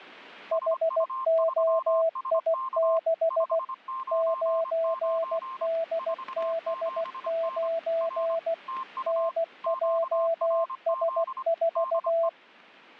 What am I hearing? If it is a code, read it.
Morse code, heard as two keyed tones. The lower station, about 16 wpm, 660 Hz: HOI6 9DB9 NJS4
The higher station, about 25 wpm, 1050 Hz: SU3SK 599 47N R TU QRZ DE